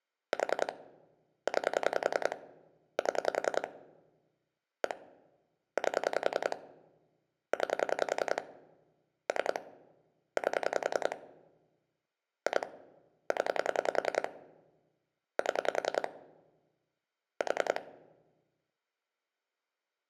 Pulse dialling, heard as clicks on a phone line, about 10 pulses a second, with room echo. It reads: 4 9 7 1 8 9 3 8 2 0 7 4